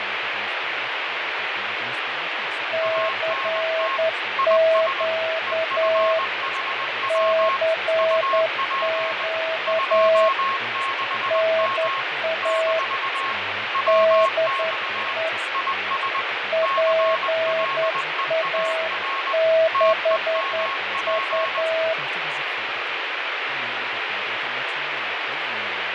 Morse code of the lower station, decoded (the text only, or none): CQ CQ NA DE PA6U